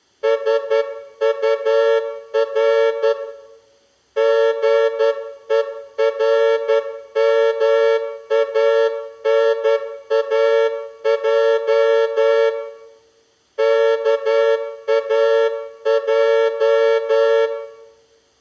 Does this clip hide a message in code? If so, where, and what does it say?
Yes: Morse code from 0.2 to 17.5 s, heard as a horn, hand-sent with a straight key, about 11 wpm, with room echo. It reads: SUR GERMANAJ KAJ